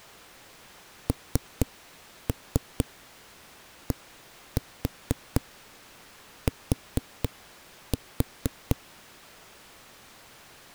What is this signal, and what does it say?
Tap code, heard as knocks on a wall, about 4 knocks a second. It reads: NDT